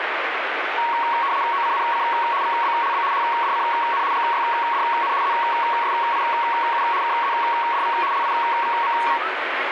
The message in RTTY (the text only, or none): OCNC VBLB HDCN GYDN ZSIU KZDV LIVM